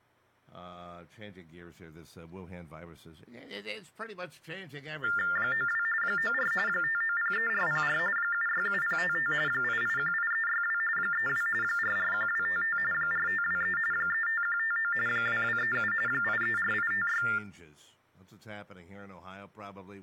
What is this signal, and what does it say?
TTY/TDD text telephone tones (45.45 baud Baudot), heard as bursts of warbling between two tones, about 400 Hz shift, 1600 Hz centre, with speech in English. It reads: 92 94 5903404 767055 8818362 32 441255 4523 35159 2237 834856